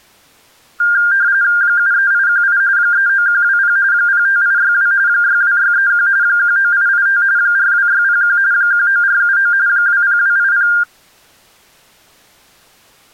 RTTY (45.45 baud, 170 Hz shift), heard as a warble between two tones, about 1500 Hz centre. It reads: 73818 39120 05862 62631 19885 42601 19479 20280